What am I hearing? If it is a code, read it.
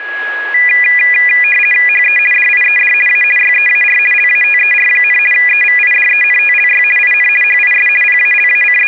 RTTY (50 baud, 450 Hz shift), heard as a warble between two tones, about 2200 Hz centre, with a steady whistle near 1670 Hz. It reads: HE DIED A YEAR LATER, EVIDENTLY IN HIS …